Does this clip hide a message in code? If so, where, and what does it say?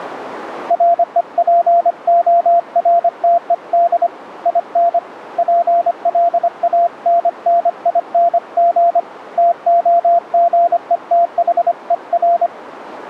Yes: Morse code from 0.6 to 12.5 s, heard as a keyed tone, hand-sent with a paddle, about 25 wpm, 690 Hz, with radio static. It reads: REPORTED IN PLANNING TOGETHER